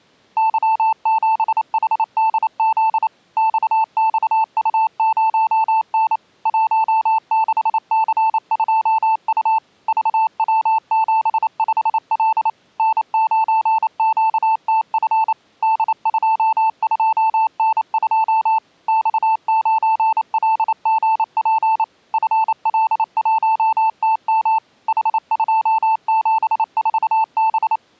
Morse code, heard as a keyed tone, machine-sent, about 28 wpm, 880 Hz. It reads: Y7HDZ XXU0N 16C2U VW75L N9QTF D22N2 X9LGP FL1TM H274B